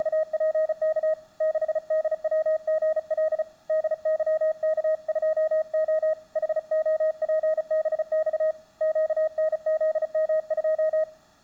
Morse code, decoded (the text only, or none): … 6DWGL DYK2O HOPBX QNZM2